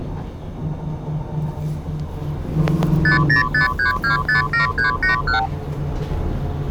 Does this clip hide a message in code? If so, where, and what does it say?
Yes: multi-frequency trunk signalling (R2, with the far end's replies) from 3.0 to 5.5 s, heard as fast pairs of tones, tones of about 120 ms, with the noise inside a bus. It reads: 5053257381